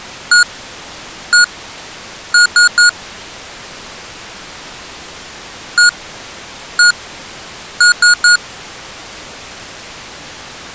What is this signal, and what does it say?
Beep code, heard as beeps from a small speaker, played twice, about 1440 Hz. 1-1-3. In Phoenix BIOS tables: CMOS read or write failure.